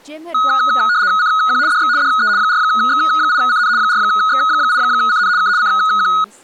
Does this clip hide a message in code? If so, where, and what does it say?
Yes: RTTY (75 baud, 170 Hz shift) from 0.3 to 6.2 s, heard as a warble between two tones, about 1360 Hz centre, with speech in English. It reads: CQ DX DE 4X8CN 4X8CN K CQ